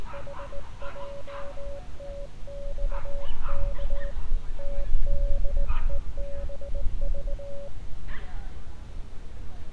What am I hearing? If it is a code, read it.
Morse code, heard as a keyed tone, hand-sent with a straight key, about 19 wpm, 560 Hz, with street noise. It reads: HJTXK TDEBV